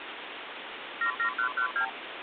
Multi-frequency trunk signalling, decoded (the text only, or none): 77112